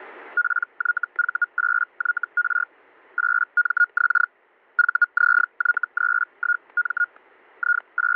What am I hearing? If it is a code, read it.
Hellschreiber (Feld-Hell, 122.5 baud), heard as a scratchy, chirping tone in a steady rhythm, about 1430 Hz, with static crashes. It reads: PYV8YR 8MX VZY31M …